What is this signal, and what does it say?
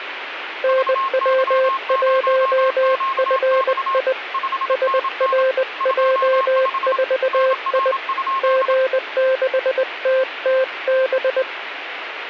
Morse code, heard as two keyed tones, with radio static. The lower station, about 20 wpm, 520 Hz: NW1FI SRJ4I G6TTB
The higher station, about 27 wpm, 1070 Hz: VY0QX 5NN 25 NR?